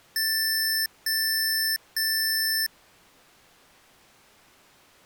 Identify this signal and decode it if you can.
Beep code, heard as beeps from a small speaker, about 1750 Hz. 3 long. In IBM BIOS tables: keyboard card error.